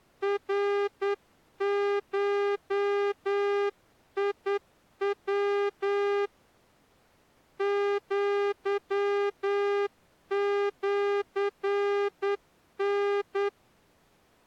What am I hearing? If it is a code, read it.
Morse code (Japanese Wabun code), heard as a horn, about 9 wpm. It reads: ナゴヤ アシタ